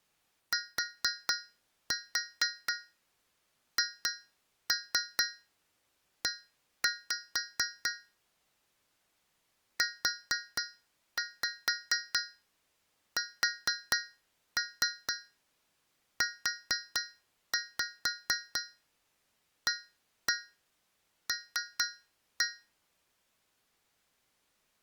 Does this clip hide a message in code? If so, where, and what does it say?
Yes: tap code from 0.5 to 22.8 s, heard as taps on a metal pipe, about 4 knocks a second. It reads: THE USUAL